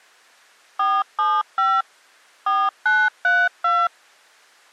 DTMF, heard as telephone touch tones, dialled by machine, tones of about 230 ms. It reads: 475 4932